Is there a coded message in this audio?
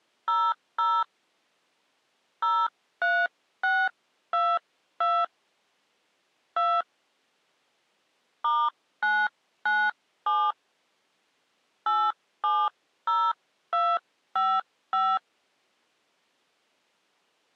Yes: DTMF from 0.3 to 15.2 s, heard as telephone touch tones, dialled by hand, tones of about 240 ms. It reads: 00 03622 2 *997 870255